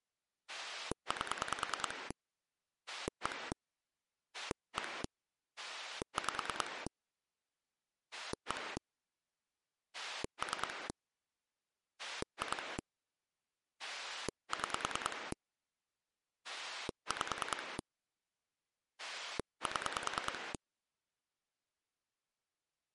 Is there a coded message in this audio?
Yes: pulse dialling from 0.5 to 20.6 s, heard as a rotary dial, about 10 pulses a second. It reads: 8 1 1 5 1 3 2 6 5 7